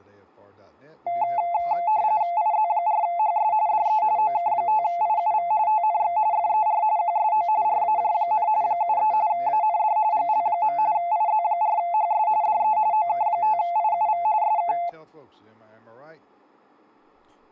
RTTY (45.45 baud, 170 Hz shift), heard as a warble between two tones, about 780 Hz centre, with speech in English. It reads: IZ4HS DE OK5IUV TNX FER QSO RAJ, 73 AND GL. IZ4HS DE OK5IUV SK